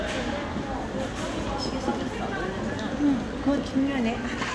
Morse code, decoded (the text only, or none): none